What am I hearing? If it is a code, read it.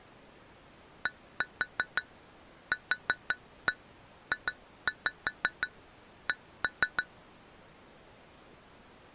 Tap code, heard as taps on glass, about 6 knocks a second. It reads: DQJC